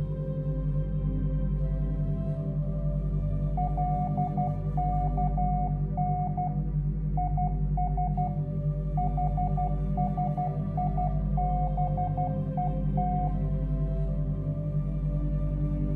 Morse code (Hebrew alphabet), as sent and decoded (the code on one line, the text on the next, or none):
.-.. -.- -. / .. ... / .... ... .. -... . -
לכן יש חשיבות